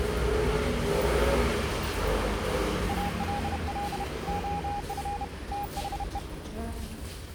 Morse code, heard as a keyed tone, hand-sent with a bug key, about 31 wpm, 820 Hz, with the noise inside a lift. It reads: ALL OF THE